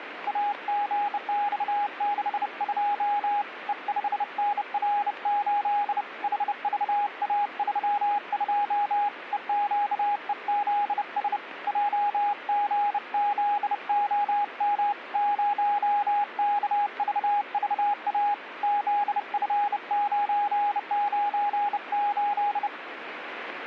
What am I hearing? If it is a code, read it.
Morse code, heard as a keyed tone, hand-sent with a bug key, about 30 wpm, 820 Hz, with radio static. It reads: AGX62 E5NR8 HVA32 EQEZS JGZOM 0KVVA ZF998